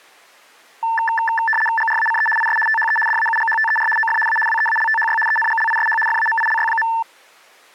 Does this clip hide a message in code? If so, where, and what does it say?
Yes: RTTY (75 baud, 850 Hz shift) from 0.8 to 7.0 s, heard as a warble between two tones, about 1330 Hz centre. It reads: GRACE IS THE DAUGHTER OF A WEALTHY ENGLISH FAMILY.